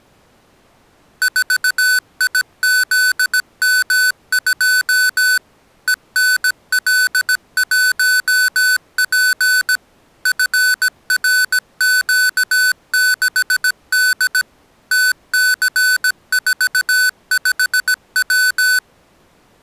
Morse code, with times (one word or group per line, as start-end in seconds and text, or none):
1.2-5.4 4IZM2
5.9-9.8 ENL1P
10.3-14.4 FRQ6D
14.9-18.8 TC45W